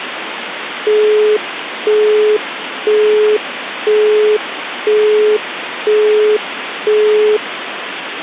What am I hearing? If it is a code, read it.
Telephone call progress tone (single-tone plan, as in Europe, Japan and elsewhere), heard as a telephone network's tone, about 420 Hz, 0.5 s on and 0.5 s off, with phone line noise. Busy tone.